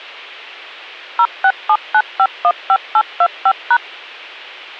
DTMF, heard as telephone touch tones, dialled by machine, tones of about 60 ms. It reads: 0679515825#